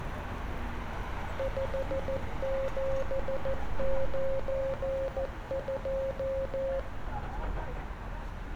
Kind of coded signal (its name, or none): Morse code